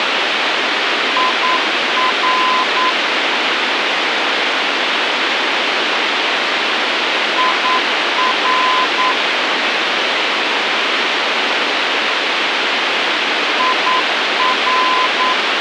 Morse code, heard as a keyed tone, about 9 wpm, 1020 Hz, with radio hiss. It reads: IR IR IR